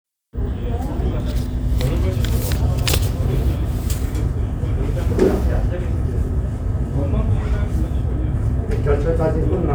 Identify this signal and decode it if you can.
The noise of a crowd indoors. There is no code.